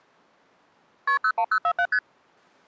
Multi-frequency trunk signalling (R1, as on North American trunks), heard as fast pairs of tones, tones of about 70 ms. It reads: KP 01047 ST